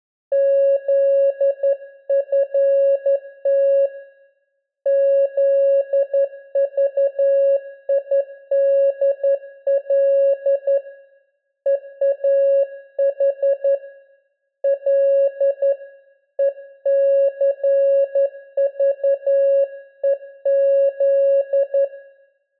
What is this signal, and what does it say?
Morse code, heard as a keyed tone, hand-sent with a straight key, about 11 wpm, 550 Hz, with room echo. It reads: ZFT ZVIDL EAH L ECVEZ